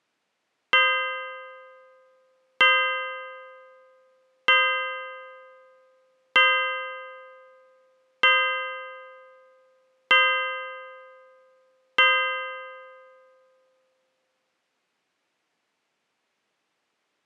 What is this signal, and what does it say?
Clock strike, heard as a bell. 7. Seven o'clock.